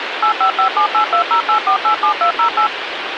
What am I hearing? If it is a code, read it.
DTMF, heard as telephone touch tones, dialled by machine, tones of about 100 ms, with phone line noise. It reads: 85578208487208